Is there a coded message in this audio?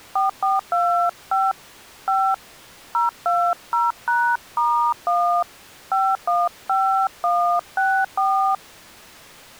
Yes: DTMF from 0.2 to 8.5 s, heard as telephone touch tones, dialled by hand, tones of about 260 ms. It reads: 4425 5 020#*1 515164